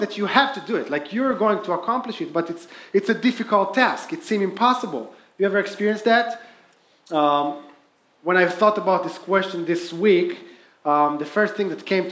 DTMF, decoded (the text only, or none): none